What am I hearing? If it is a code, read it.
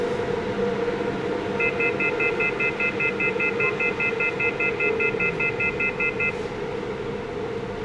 Telephone call progress tone (North American plan), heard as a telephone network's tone, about 1400, 2050, 2450, 2600 Hz, 0.1 s on and 0.1 s off, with room echo and the noise inside a subway train. Off-hook warning tone.